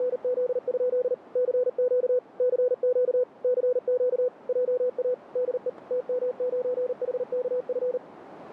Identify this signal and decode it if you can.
Morse code, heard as a keyed tone, machine-sent, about 39 wpm, 500 Hz, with radio static. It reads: … CQ CQ CQ JA DE TM9HKF